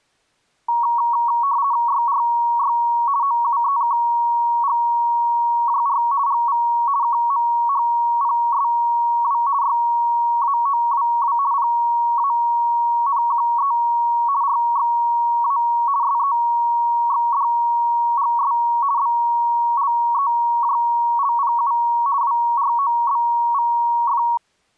RTTY (50 baud, 170 Hz shift), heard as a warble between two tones, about 1030 Hz centre. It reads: YRY OUEKGJR GV KMHPSW YAOWW PANQE RXA SEXDGS BLEJLPU WROBVF